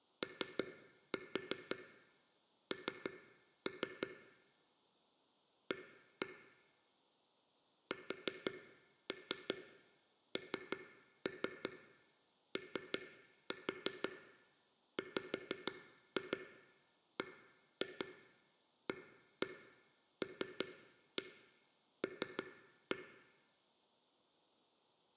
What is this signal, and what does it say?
Tap code, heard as taps on a table, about 5 knocks a second, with room echo. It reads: ON A SNOWBALL